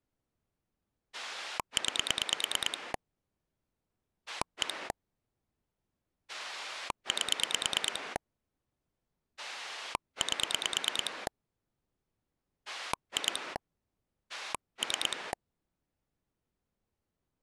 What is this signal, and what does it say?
Pulse dialling, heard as a rotary dial, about 9 pulses a second. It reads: 9 1 8 8 2 3